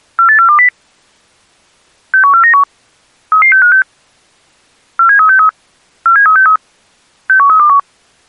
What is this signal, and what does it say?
Five-tone selective call (CCIR), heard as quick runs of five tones, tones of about 100 ms. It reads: 48420 61491 33656 47363 47363 61321